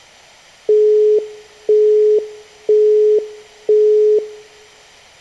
Telephone call progress tone (single-tone plan, as in Europe, Japan and elsewhere), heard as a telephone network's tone, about 420 Hz, 0.5 s on and 0.5 s off. Busy tone.